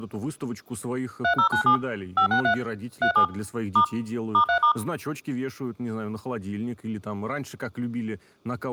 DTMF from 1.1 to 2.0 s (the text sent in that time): 3097